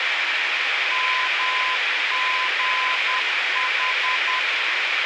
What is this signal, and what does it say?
Morse code, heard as a keyed tone, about 10 wpm, 1020 Hz, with radio hiss. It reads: MGH